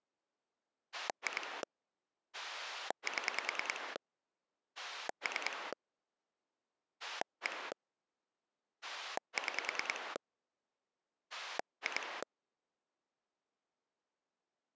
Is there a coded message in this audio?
Yes: pulse dialling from 0.9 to 12.2 s, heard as a rotary dial, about 10 pulses a second. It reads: 2 7 3 1 6 2